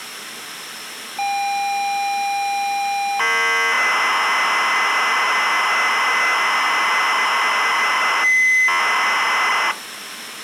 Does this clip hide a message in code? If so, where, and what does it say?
Yes: ZX Spectrum tape loading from 1.2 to 9.7 s, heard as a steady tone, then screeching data, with tape hiss.